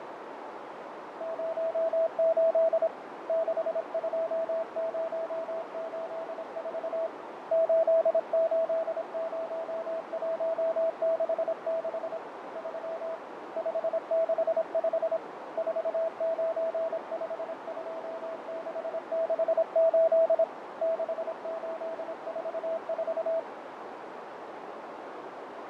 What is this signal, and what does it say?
Morse code, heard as a keyed tone, hand-sent with a paddle, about 26 wpm, 660 Hz, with heavy radio static, fading and a narrow filter. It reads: 08 62084 880166 3 565 4952668 6844